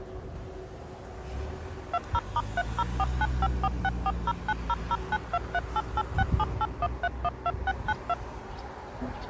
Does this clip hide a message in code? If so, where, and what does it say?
Yes: DTMF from 1.9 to 8.1 s, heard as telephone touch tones, dialled by machine, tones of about 40 ms, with street noise. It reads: 20*304954640900923886781312692